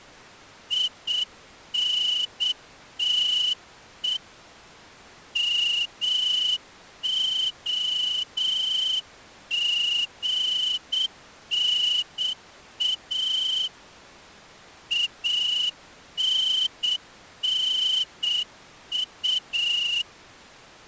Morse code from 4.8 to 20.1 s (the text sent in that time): MOGNA ANNU